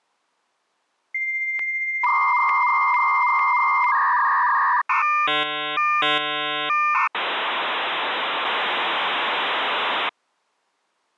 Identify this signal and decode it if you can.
Dial-up modem handshake (V.34 or later), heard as a whistle, warbles, then hiss.